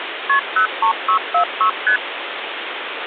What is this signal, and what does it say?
Multi-frequency trunk signalling (R1, as on North American trunks), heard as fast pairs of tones, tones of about 100 ms, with phone line noise. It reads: KP 03646 ST